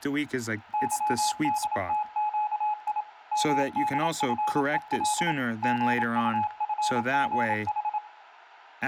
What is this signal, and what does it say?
Morse code, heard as a keyed tone, machine-sent, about 27 wpm, 850 Hz, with room echo and speech in English. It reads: YDTQI MDFEL GUFGH